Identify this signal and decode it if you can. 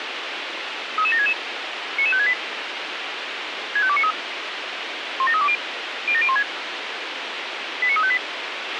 Five-tone selective call (ZVEI), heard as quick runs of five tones, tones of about 70 ms, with radio hiss and a squelch burst at the end. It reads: 33766 99568 65293 17320 07016 89358